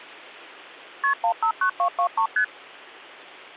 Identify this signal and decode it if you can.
Multi-frequency trunk signalling (R1, as on North American trunks), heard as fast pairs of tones, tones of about 90 ms, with hum. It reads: KP 159223 ST